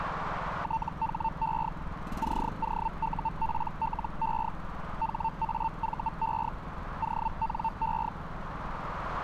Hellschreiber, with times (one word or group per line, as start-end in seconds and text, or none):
0.6-1.7 THE
2.2-4.5 COUPLE
5.0-6.5 HAVE
7.0-8.1 ONE